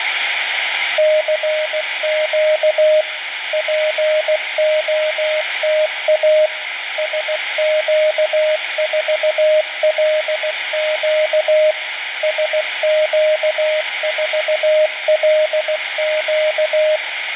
Morse code, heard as a keyed tone, machine-sent, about 16 wpm, 620 Hz, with radio static. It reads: CQ POTA SQ4LQ SQ4LQ